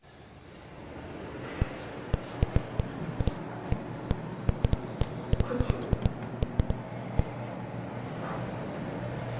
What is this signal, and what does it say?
Irregular knocks on a wall, with the noise inside a lift. There is no code.